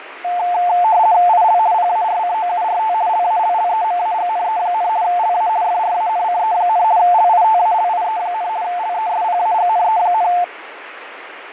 RTTY (50 baud, 170 Hz shift), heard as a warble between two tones, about 790 Hz centre, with radio static and fading. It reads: IL PARCOURT LALLEMAGNE, LA FRANCE, LITALIE, LESPAGNE,